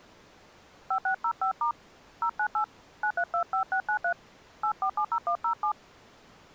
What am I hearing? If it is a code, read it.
DTMF, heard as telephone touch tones, dialled by hand, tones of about 80 ms. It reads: 5605* 098 9325693 8470107